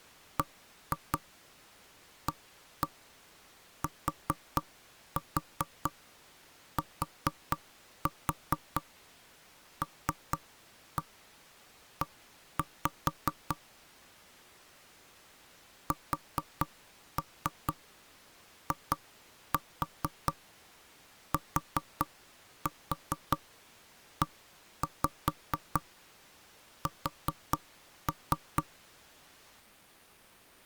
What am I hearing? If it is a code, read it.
Tap code, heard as knocks on wood, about 4 knocks a second. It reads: BATTLE SITES